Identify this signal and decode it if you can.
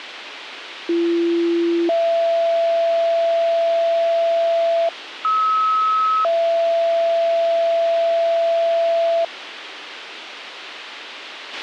Two-tone page, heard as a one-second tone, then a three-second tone, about 340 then 670 Hz, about 1290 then 670 Hz, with radio hiss and a squelch burst at the end.